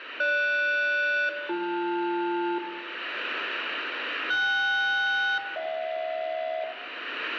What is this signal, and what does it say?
Aircraft SELCAL, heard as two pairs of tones, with radio static and room echo. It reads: GS-BL KS-HJ